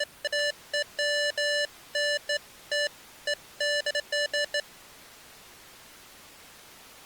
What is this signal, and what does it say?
Beeps of irregular length. There is no code.